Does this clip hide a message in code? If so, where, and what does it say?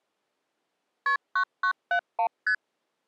Yes: multi-frequency trunk signalling (R1, as on North American trunks) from 1.1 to 2.5 s, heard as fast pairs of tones, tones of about 80 ms. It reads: KP 9971 ST